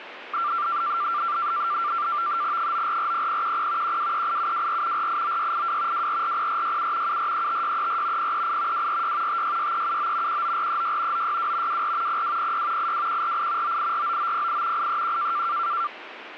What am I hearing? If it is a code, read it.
NAVTEX (SITOR-B), 100 baud, 170 Hz shift, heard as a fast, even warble, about 1270 Hz centre, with radio static. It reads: 9440010 1238724 489682 2440467 7435634 038 246 566379 19436 962 24 0206 82148 9849908 831